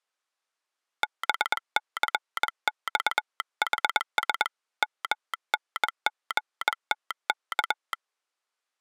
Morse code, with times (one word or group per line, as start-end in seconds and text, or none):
1.0-4.5 BCXHS
4.8-7.9 MNGTK